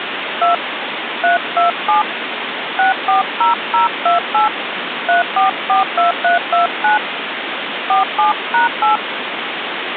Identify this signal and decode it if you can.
DTMF, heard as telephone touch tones, dialled by hand, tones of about 130 ms, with phone line noise. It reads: 2 327 640028 3442329 47#8